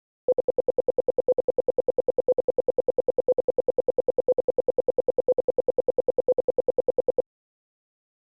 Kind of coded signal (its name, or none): radio time signal